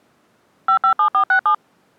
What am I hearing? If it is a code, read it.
DTMF, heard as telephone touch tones, dialled by machine, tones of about 90 ms. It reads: 557467